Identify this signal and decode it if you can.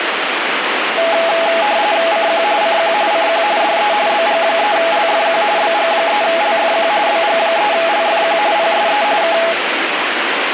RTTY (45.45 baud, 170 Hz shift), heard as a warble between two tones, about 750 Hz centre, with radio static. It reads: CQ CQ CQ DE BG3LFQ BG3LFQ BG3LFQ PSE K